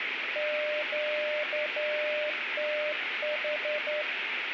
Morse code, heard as a keyed tone, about 10 wpm, 600 Hz, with radio static. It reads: QTH